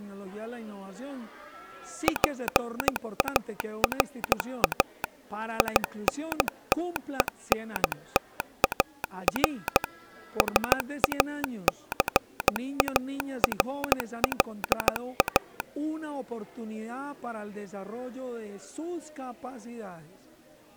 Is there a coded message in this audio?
Yes: Morse code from 2.0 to 15.7 s, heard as a telegraph sounder, machine-sent, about 15 wpm. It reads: PARA INTENTAR SACARLA